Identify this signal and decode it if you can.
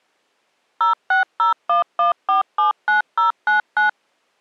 DTMF, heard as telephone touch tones, dialled by machine, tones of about 130 ms. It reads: 06011479099